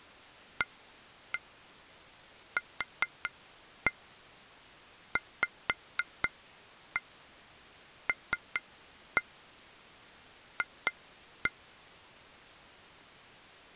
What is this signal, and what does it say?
Tap code, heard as taps on glass, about 4 knocks a second. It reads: AQVLF